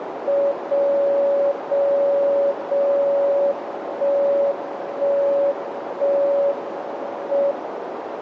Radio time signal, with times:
0.5-1.5 0
1.5-2.5 0
2.5-3.5 0
3.5-4.5 1
4.5-5.5 1
5.5-6.5 1
6.5-7.5 M

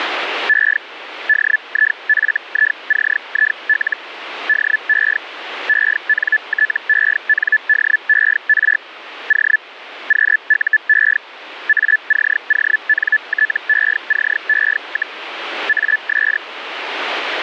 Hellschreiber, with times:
0.5-0.8 E
1.3-4.0 DIFICIL
4.5-5.2 DE
5.7-8.8 ENTENDER
9.3-9.6 O
10.1-11.2 QUE
11.7-15.2 ACONTECE,
15.7-16.4 AS

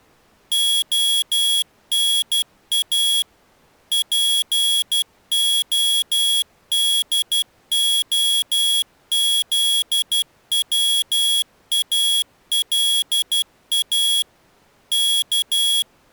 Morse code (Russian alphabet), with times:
0.5-3.2 ОНА
3.9-14.2 ПОДОЗВАЛА
14.9-15.8 К

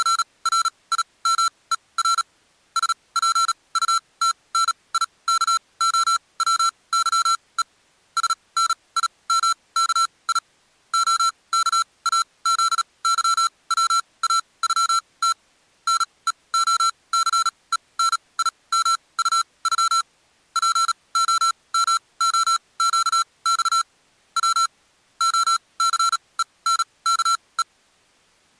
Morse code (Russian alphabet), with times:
0.0-2.2 …
2.8-7.6 СПУТНИКОВЫЕ
8.2-10.4 СНИМКИ
10.9-15.3 ОКАЗЫВАЮТ
15.9-20.0 НЕОЦЕНИМУЮ
20.6-23.8 ПОМОЩЬ
24.4-24.7 В
25.2-27.6 ОЦЕНКЕ

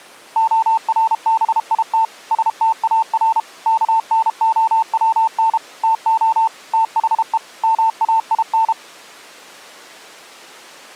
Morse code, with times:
0.4-2.0 ORBIT
2.3-3.4 STAR
3.7-5.6 KNOWN
5.8-6.5 TO
6.7-7.4 THE
7.6-8.7 MAIN

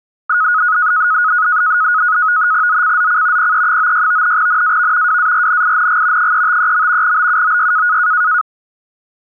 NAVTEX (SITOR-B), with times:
2.7-3.5 ZCZC
3.4-4.4 PE96
4.4-5.2 NAV
5.1-6.3 WARNING
6.2-7.2 353.
7.0-8.0 BUOY

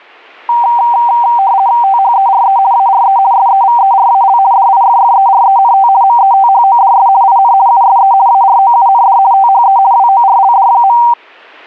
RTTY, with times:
1.8-2.6 THERE
2.7-3.2 ARE
3.3-4.4 SEVERAL
4.5-5.9 DIFFERENT
6.0-7.1 METHODS
7.2-7.5 IN
7.7-8.1 USE
8.3-9.2 AROUND
9.3-9.8 THE
9.9-11.0 WORLD.

